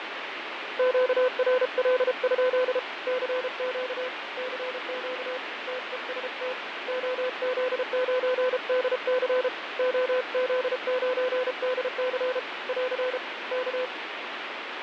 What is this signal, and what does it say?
Morse code, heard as a keyed tone, hand-sent with a paddle, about 33 wpm, 510 Hz, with radio static and fading. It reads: QRL? CQ CQ TEST OZ9DC OZ9DC <AR> K